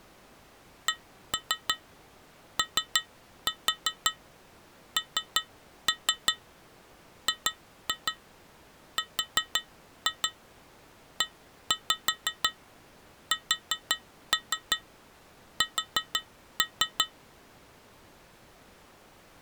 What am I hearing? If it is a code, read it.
Tap code, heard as taps on glass, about 5 knocks a second. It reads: CONGRESS